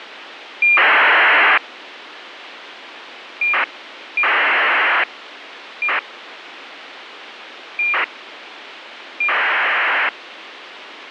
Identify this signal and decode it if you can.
ACARS aircraft data, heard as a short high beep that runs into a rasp, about 2400 baud, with radio hiss.